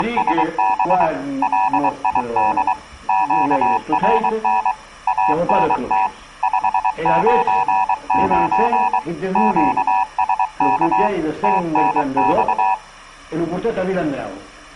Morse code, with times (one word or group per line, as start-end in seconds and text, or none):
0.0-1.1 …
1.4-2.7 LID
3.1-4.7 QRN
5.1-6.1 ANT
6.4-9.0 599
9.4-11.1 QSK
11.4-12.7 TNX